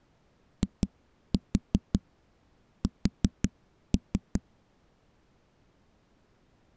Tap code, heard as knocks on a wall, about 5 knocks a second. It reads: IS